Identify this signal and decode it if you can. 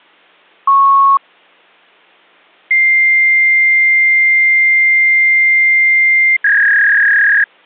Fax machine handshake, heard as a beep, a long tone and a warble.